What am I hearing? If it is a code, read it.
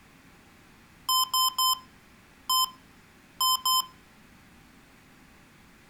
Beep code, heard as beeps from a small speaker, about 1030 Hz, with room echo. 3-1-2. In Phoenix BIOS tables: DMA register failure.